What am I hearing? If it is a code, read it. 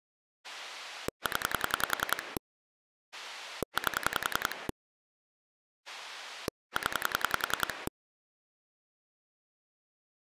Pulse dialling, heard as a rotary dial, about 10 pulses a second. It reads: 0 8 0